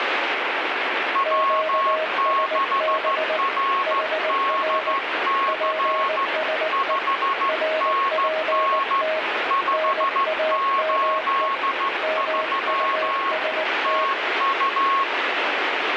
Morse code, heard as two keyed tones, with heavy radio static. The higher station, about 14 wpm, 1090 Hz: W6RDC 5NN 583 TU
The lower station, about 19 wpm, 630 Hz: QSB HR PSE RPT NAME MUST